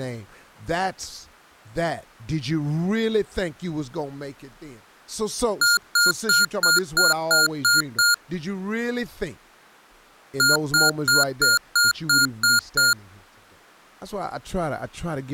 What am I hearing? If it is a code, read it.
Beep code, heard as beeps from a small speaker, played twice, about 1420 Hz, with speech in English. 8 short. In AMI BIOS tables: display memory failure; in Dell tables: LCD failure.